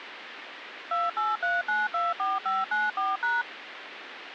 DTMF, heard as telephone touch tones, dialled by machine, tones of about 190 ms, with phone line noise. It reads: 283924594#